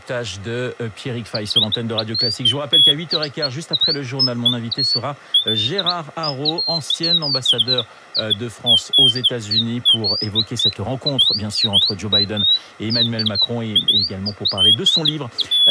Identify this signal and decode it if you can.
Bird-like chirps, with speech in French. There is no code.